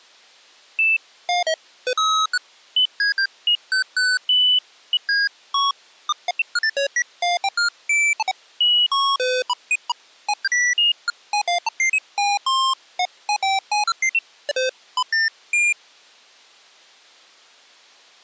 Electronic bleeps of random pitch and length. There is no code.